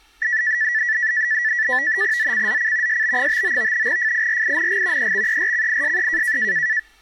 NAVTEX (SITOR-B), 100 baud, 170 Hz shift, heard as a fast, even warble, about 1850 Hz centre, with speech in Bangla. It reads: ZCZC SB59 FIRING EXERCISE